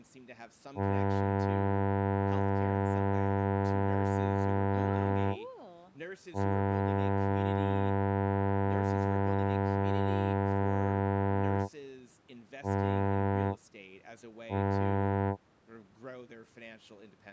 Ship horn signal, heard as a ship's horn, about 100 Hz, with speech in English. 2 long, 2 short. At sea: I intend to overtake on your port side.